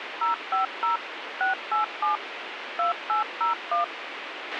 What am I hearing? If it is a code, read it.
DTMF, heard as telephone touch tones, dialled by machine, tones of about 130 ms, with radio hiss and a squelch burst at the end. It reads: 050 687 2801